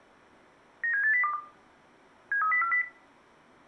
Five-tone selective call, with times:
0.8-1.3 97802
2.3-2.8 73040

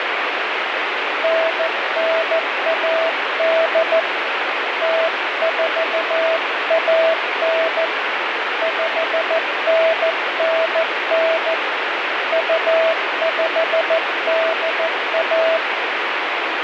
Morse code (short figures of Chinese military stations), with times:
1.2-4.0 9918
4.8-7.8 0419
8.6-11.5 5999
12.3-15.6 2581

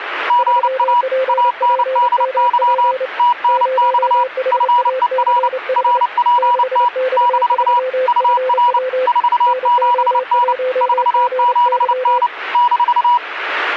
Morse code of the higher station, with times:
0.3-1.0 GA
1.3-2.9 ANDY
3.2-4.2 TNX
4.5-5.5 FER
5.8-6.9 RPT
7.2-7.8 -
8.1-8.8 UR
9.1-10.5 47N
10.8-12.3 47N
12.5-13.2 -

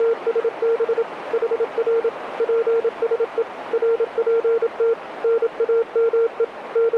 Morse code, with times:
0.0-1.0 …
1.3-2.1 HR
2.4-3.4 PSE
3.7-4.9 RPT
5.2-6.4 NAME
6.8-7.0 …

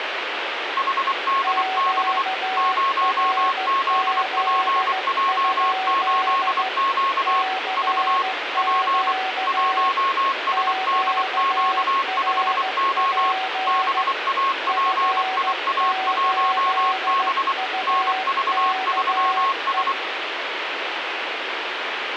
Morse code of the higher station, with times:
0.8-2.2 HDB
2.6-7.4 0ZPJ8Q
7.8-8.2 V
8.6-9.1 P
9.5-13.3 1SDQ5O
13.7-17.5 BAPIA1B
17.9-19.9 NV3S

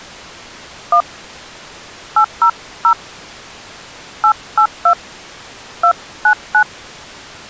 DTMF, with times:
0.9-1.0 1
2.2-2.9 800
4.2-4.9 882
5.8-6.6 299

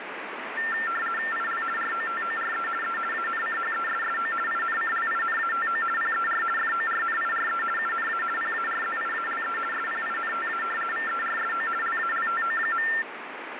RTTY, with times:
1.3-1.6 IL
1.8-2.7 ROTORE
2.8-3.0 E
3.1-4.3 ANCHESSO
4.5-5.8 INCLINATO
6.0-6.4 PER
6.6-7.6 FORNIRE
7.8-8.2 UNA
8.4-9.6 PARZIALE
9.7-10.6 SPINTA
10.9-11.7 VERSO
11.8-12.9 LALTO.

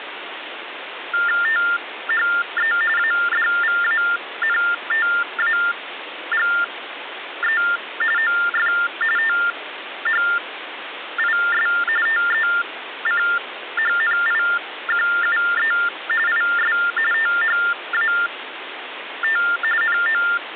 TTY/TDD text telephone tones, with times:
1.4-2.7 THE
3.0-7.6 ADVANTAGE
8.2-8.7 OF
9.2-11.7 THIS
12.1-15.7 TECHNIQUE
16.3-16.8 IS
17.1-19.4 THAT
19.8-20.2 NO

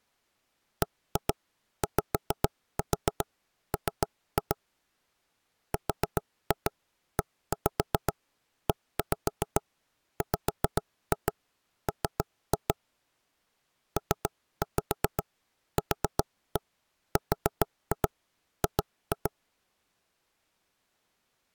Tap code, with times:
0.8-4.6 BYM
5.7-12.7 REEWM
14.0-19.3 PQRG

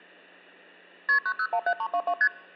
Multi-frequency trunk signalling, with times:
1.1-1.2 KP
1.3-2.1 9017322
2.2-2.3 ST

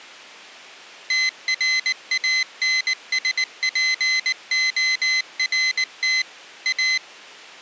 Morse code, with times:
1.1-6.2 TRANSPORT
6.7-7.0 A

